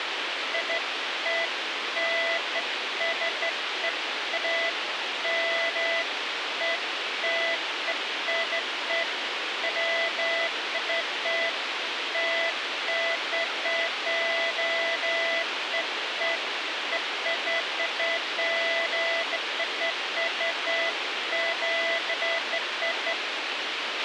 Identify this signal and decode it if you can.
Beeps of irregular length, with radio hiss and a squelch burst at the end. There is no code.